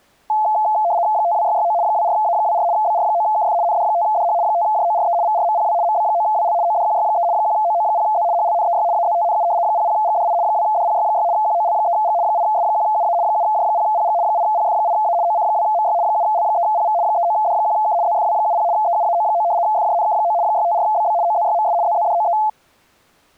RTTY (75 baud, 170 Hz shift), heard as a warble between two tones, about 770 Hz centre. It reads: 52669 24A24 BR9KF ND5DH 5JORE VRMPW MB9WL ODQY3 1OO0Z HLNEY AZTNU 00GDI 2DPY6 QOL3G 8S1UA 7J0PG 8PF8A OC2MY 7L3PV 39D1K ZFW70 EUAO9 FJNK9 654BB OZYMS ZZDOE